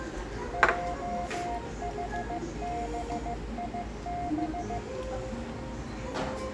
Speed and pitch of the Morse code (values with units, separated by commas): 15 wpm, 710 Hz